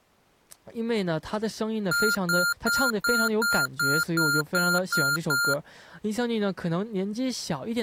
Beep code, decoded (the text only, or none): 10 short